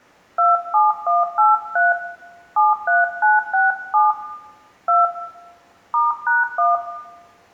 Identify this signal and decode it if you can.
DTMF, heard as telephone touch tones, dialled by hand, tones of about 170 ms, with room echo. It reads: 27183 73967 2 *#1